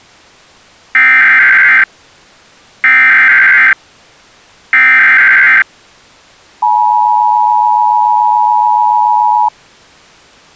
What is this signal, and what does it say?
Emergency Alert System (SAME) tones (header bursts, then the 853 and 960 Hz attention tone), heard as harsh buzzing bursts, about 520.83 baud.